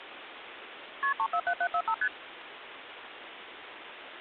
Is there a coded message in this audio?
Yes: multi-frequency trunk signalling (R1, as on North American trunks) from 1.0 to 2.1 s, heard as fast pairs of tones, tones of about 70 ms, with phone line noise. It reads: KP 347745 ST